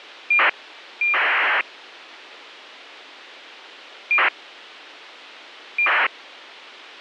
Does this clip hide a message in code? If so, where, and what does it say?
Yes: ACARS aircraft data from 0.3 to 6.1 s, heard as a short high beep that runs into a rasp, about 2400 baud, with radio hiss.